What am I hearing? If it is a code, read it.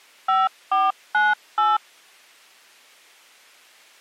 DTMF, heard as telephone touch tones, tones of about 190 ms. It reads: 5498